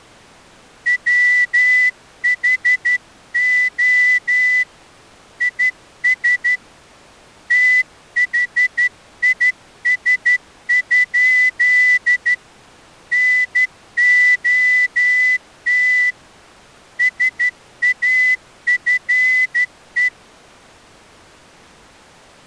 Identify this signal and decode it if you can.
Morse code, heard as a whistle, hand-sent with a straight key, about 12 wpm. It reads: WHO IS THIS? NOT SAFE